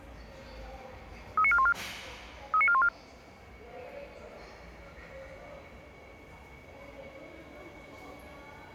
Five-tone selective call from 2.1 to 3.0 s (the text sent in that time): 39414